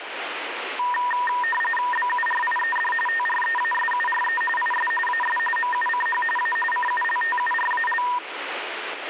RTTY (45.45 baud, 850 Hz shift), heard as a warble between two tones, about 1410 Hz centre, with radio static. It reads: BURIED TREASURE IS AS MUCH A CULTURAL